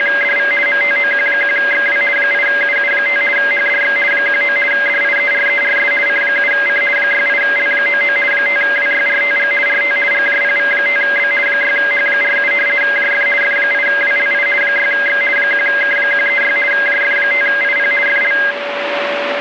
RTTY (50 baud, 450 Hz shift), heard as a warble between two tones, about 1850 Hz centre, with radio static and a steady whistle near 570 Hz. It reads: … MTOQ1XW 8UU5 HDX 19 DIERERS C7C 68L99 5WYRTG RT GJPV5B 6H47 JF F8WLI 6X 1K136 JF5IP FL